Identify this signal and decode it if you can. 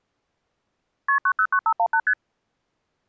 Multi-frequency trunk signalling (R1, as on North American trunks), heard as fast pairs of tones, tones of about 70 ms. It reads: KP 909518 ST